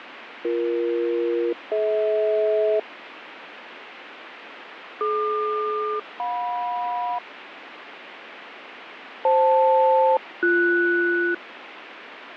Aircraft SELCAL, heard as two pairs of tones, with radio static and fading. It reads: BE-DH DQ-JM FL-BS